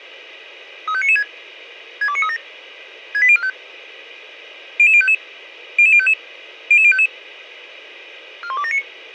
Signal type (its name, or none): five-tone selective call